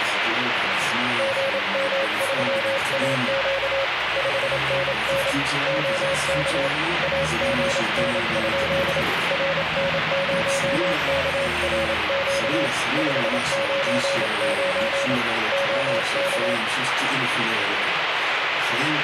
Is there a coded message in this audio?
Yes: Morse code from 1.1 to 16.6 s, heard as a keyed tone, hand-sent with a paddle, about 27 wpm, 550 Hz, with radio static. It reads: GM3AQ 5NN OK AGN? RN0KRQ 599 OK